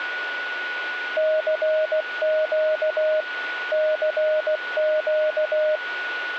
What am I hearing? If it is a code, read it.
Morse code, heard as a keyed tone, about 16 wpm, 620 Hz, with radio static and a steady whistle near 1460 Hz. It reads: CQ CQ